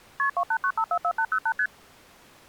Multi-frequency trunk signalling (R1, as on North American trunks), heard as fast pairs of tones, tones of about 70 ms. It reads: KP 289544808 ST